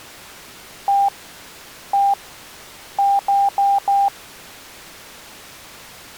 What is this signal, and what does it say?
Beep code, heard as beeps, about 800 Hz. 1-1-4. In Phoenix BIOS tables: BIOS ROM checksum failure.